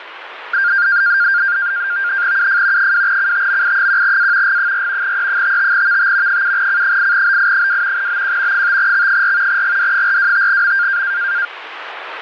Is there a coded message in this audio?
Yes: NAVTEX (SITOR-B), 100 baud, 170 Hz shift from 0.5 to 11.5 s, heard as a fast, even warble, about 1500 Hz centre, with radio static. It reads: UF 2CTMI1A G4 E55VT 7C8BI2 BQ 5X4 GD425M